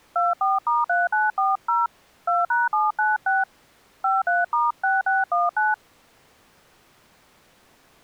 DTMF, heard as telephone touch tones, dialled by hand, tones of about 180 ms. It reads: 24*3940 2#796 53*6619